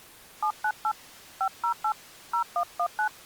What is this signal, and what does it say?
DTMF, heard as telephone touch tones, dialled by hand, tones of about 80 ms. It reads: 798 508 0119